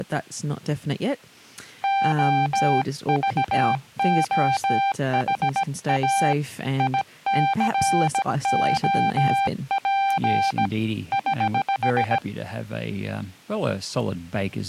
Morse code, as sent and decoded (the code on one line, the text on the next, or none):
--- ...- --- .... .- / .. -.-. --- .--. / ........
OVOHA ICOP <HH>